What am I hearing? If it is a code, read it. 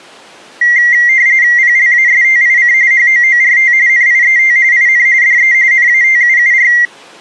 RTTY (45.45 baud, 170 Hz shift), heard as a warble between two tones, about 2000 Hz centre. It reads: PLASTIC HOORT NIET IN DE NATUUR